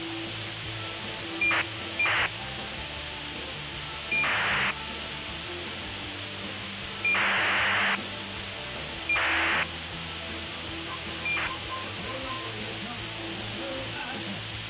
ACARS aircraft data, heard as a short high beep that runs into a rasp, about 2400 baud, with radio hiss.